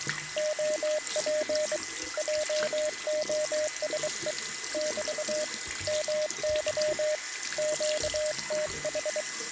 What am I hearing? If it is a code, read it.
Morse code, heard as a keyed tone, hand-sent with a bug key, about 23 wpm, 610 Hz, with a steady whistle near 2020 Hz and the noise of a restroom. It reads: OP JOSE <BT> MY QTH